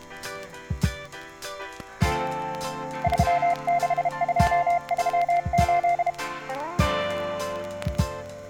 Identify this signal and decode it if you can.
Morse code, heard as a keyed tone, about 32 wpm, 700 Hz. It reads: 36238